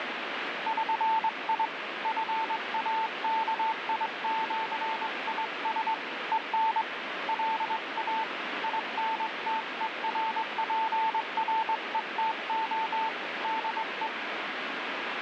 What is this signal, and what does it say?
Morse code (with Esperanto letters), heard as a keyed tone, hand-sent with a straight key, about 22 wpm, 890 Hz, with radio static. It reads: ŜI FAKIĜIS EN LA INTERPRETO DE